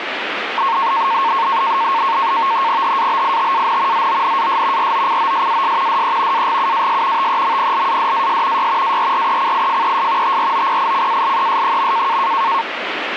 NAVTEX (SITOR-B), 100 baud, 170 Hz shift, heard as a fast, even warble, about 1000 Hz centre, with radio static. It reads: HABITAN ZONAS ROCOSAS DE AGUAS TEMPLADAS Y ARRECIFES TROPICALES.